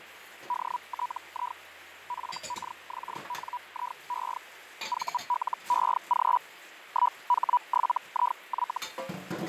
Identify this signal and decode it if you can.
Hellschreiber (Feld-Hell, 122.5 baud), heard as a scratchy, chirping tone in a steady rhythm, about 980 Hz, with radio static, fading and kitchen noise. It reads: DTI FKXNIE VLEG 1H7IY